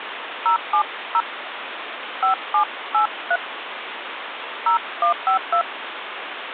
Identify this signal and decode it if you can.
DTMF, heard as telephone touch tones, dialled by hand, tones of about 80 ms, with phone line noise. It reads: 070 5783 0152